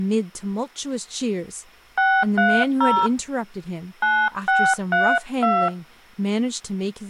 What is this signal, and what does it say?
DTMF, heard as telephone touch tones, dialled by hand, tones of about 260 ms, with speech in English. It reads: 630 9632